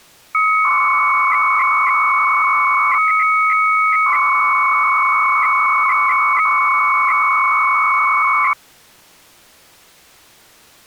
300-baud modem data (Bell 103 tones), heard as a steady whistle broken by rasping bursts, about 300 baud, 200 Hz shift.